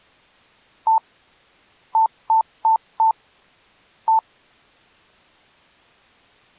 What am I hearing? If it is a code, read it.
Beep code, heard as beeps, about 890 Hz. 1-4-1. In Phoenix BIOS tables: address line failure in the first 64 KB of memory.